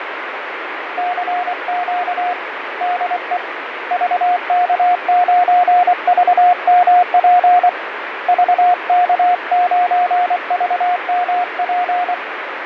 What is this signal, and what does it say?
Morse code, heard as a keyed tone, hand-sent with a paddle, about 24 wpm, 720 Hz, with radio static and fading. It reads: CQ DE VK9VMP VK9VMP